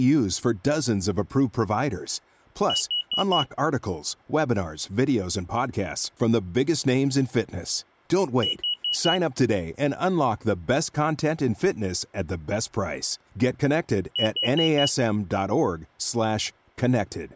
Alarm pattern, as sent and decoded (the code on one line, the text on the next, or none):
4 beeps and a pause
temporal four